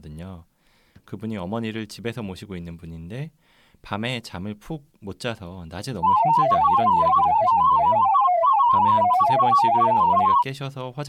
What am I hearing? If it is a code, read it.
Multi-tone FSK (Olivia or MFSK type), about 500 Hz wide, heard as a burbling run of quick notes, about 31.25 baud, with speech in Korean.